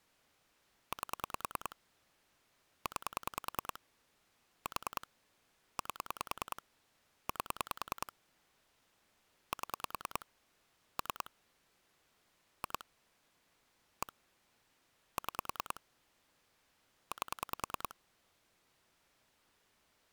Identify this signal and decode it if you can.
Pulse dialling, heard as clicks on a phone line, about 10 pulses a second. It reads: 8 9 4 8 8 7 3 2 1 6 8